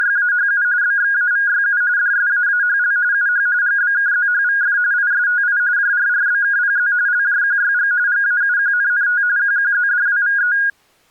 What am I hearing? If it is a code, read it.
RTTY (45.45 baud, 170 Hz shift), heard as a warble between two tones, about 1550 Hz centre. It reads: … BXAVYU DSAAHL UH GBKZHVF ISTI JRRBKPZ LJQYG GAUQNNT QQZDWVE